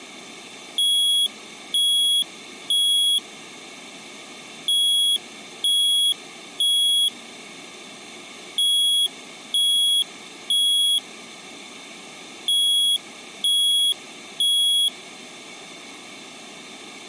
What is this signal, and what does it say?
Alarm pattern, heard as an alarm's beeps, played four times, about 3350 Hz. Temporal three. Smoke or fire, evacuate.